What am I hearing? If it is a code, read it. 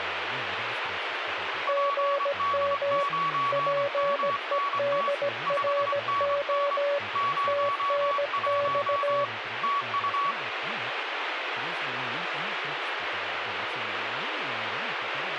Morse code, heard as two keyed tones, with radio static and speech in Russian. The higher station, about 24 wpm, 1130 Hz: PD9MNT 5NN 01 TU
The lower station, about 17 wpm, 570 Hz: GM PEDRO TNX